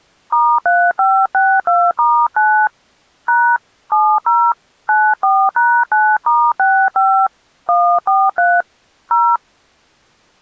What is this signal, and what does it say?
DTMF, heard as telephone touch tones, dialled by hand, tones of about 260 ms. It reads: *3562*9 # 70 94#9*65 143 0